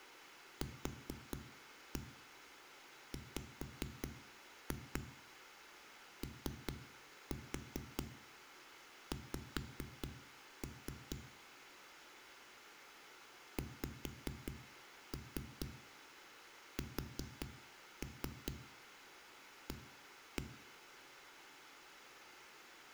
Tap code, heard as knocks on a wall, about 4 knocks a second, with room echo. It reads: QWOX XSA